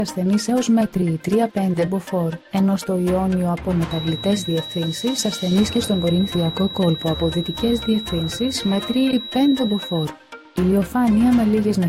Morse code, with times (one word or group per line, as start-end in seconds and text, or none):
none